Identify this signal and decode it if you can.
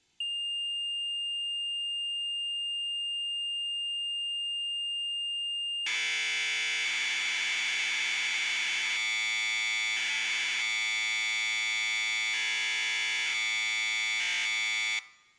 Commodore tape loading (standard loader), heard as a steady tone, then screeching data.